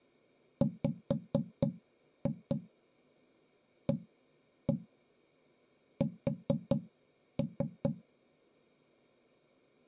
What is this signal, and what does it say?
Tap code, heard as knocks on wood, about 4 knocks a second. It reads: WAS